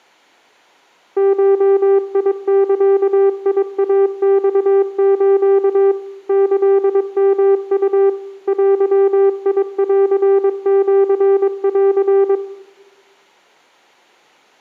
Morse code (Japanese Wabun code), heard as a keyed tone, machine-sent, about 22 wpm, 390 Hz, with room echo. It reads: ゴザイマス キヨウ デンシン